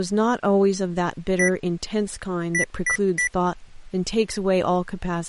Beep code, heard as beeps from a small speaker, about 1950 Hz, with speech in English. 1-3.